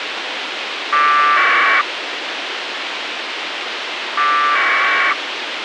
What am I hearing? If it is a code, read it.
Packet radio (AX.25, as in APRS), 1200 baud, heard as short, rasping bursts, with radio hiss and a squelch burst at the end.